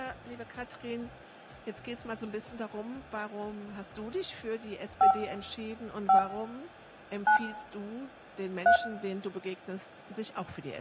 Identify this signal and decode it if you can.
DTMF, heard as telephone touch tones, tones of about 100 ms, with room echo. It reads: 5 5 9 3